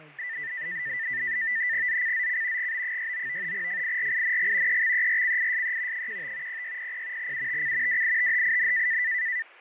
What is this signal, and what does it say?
NAVTEX (SITOR-B), 100 baud, 170 Hz shift, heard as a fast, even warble, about 1900 Hz centre, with radio static, fading and speech in English. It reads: ZCZC GB69 FIRING EXERCISE 15 0600 UTC WITHIN